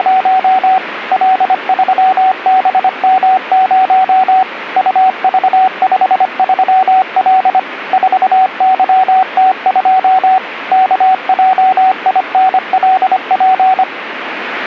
Morse code, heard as a keyed tone, machine-sent, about 25 wpm, 750 Hz, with radio static. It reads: … L3BM0 UV53L 4YT2 KJINLP